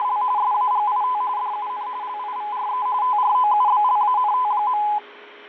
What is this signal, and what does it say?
RTTY (45.45 baud, 170 Hz shift), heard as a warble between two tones, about 920 Hz centre, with radio static, fading and a steady whistle near 410 Hz. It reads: … SAGIT DUN LIVRE TROUBLANT.